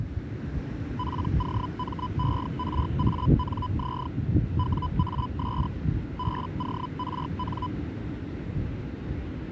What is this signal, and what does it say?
Hellschreiber (Feld-Hell, 122.5 baud), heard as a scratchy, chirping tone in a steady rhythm, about 1000 Hz, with the noise of a residential street. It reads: POMERANZ WAS BORN